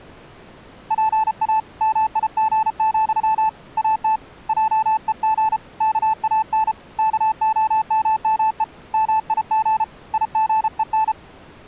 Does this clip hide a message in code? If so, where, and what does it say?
Yes: Morse code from 0.8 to 11.2 s, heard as a keyed tone, hand-sent with a paddle, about 33 wpm, 880 Hz. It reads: PA MIG, AT JEG KAN KOMME MIG IGEN